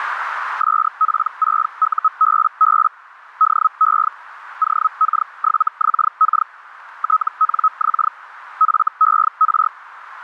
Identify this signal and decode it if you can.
Hellschreiber (Feld-Hell, 122.5 baud), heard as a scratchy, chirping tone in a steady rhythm, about 1280 Hz, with radio static and a narrow filter. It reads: SP6UBB DE OK7XK TNX FER